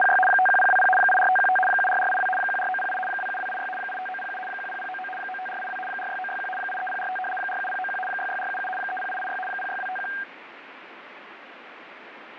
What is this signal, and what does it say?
RTTY (75 baud, 850 Hz shift), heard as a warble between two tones, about 1170 Hz centre, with radio static and fading. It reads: … 51020 84515 74482 14908 27286 85907 10099 95482 46961 83045 47091 66477 30886 06251